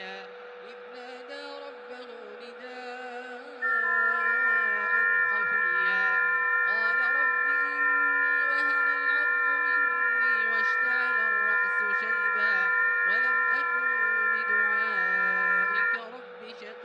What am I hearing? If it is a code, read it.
FT8 (several signals at once), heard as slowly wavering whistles, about 6.25 baud, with a steady whistle near 490 Hz and room echo.